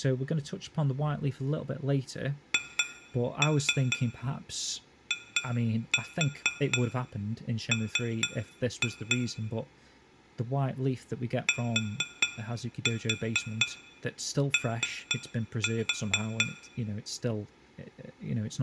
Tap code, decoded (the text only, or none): HIM TO